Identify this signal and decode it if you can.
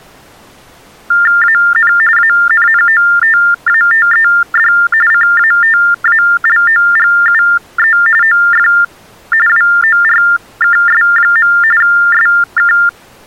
TTY/TDD text telephone tones (45.45 baud Baudot), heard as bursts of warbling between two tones, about 400 Hz shift, 1600 Hz centre. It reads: AN ANNOTATED CATALOGUE OF WORKS. SK